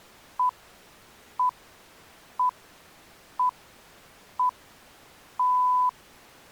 Radio time signal (six pips, as the Greenwich Time Signal), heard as pips.